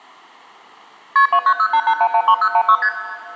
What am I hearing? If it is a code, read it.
Multi-frequency trunk signalling (R1, as on North American trunks), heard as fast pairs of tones, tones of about 70 ms, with room echo. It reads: KP 29088113016 ST